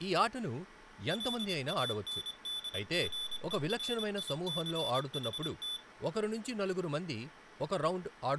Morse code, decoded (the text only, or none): LANDGERICHT